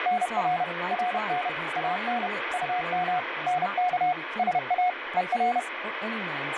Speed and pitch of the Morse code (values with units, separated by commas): 31 wpm, 720 Hz